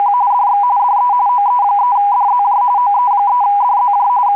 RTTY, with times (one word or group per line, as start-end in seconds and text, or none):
0.0-0.1 …
0.3-0.6 DX
0.8-1.1 DE
1.3-2.6 OE3DZJ
2.8-4.1 OE3DZJ
4.3-4.4 …